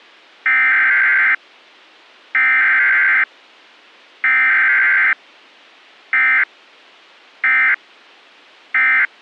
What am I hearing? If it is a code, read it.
Emergency Alert System (SAME) tones (header bursts, then end-of-message bursts), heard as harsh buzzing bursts, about 520.83 baud.